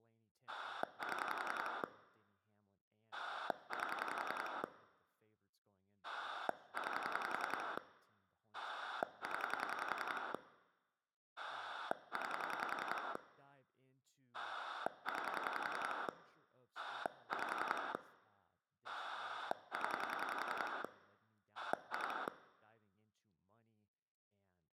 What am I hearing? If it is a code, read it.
Pulse dialling, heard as a rotary dial, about 10 pulses a second, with speech in English. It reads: 7 8 9 0 9 9 5 0 2